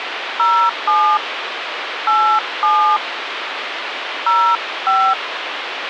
DTMF, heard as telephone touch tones, dialled by hand, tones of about 250 ms, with phone line noise. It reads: 07 87 05